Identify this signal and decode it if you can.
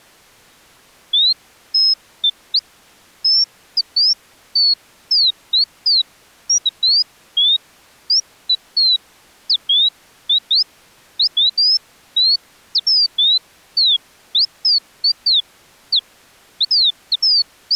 Bird-like chirps. There is no code.